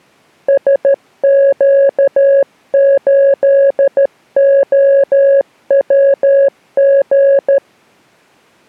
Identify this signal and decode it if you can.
Morse code, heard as a keyed tone, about 13 wpm, 550 Hz. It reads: SQ8OWG